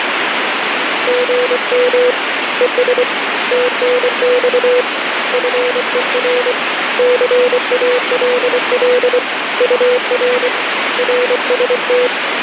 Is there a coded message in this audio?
Yes: Morse code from 1.0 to 12.1 s, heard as a keyed tone, hand-sent with a paddle, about 24 wpm, 500 Hz, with radio static. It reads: GM ES TNX FER CALL UR RST